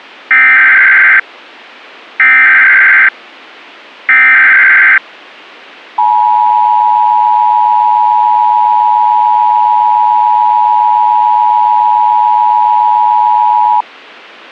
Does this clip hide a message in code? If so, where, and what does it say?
Yes: Emergency Alert System (SAME) tones (header bursts, then the 853 and 960 Hz attention tone) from 0.3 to 13.8 s, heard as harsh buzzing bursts, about 520.83 baud.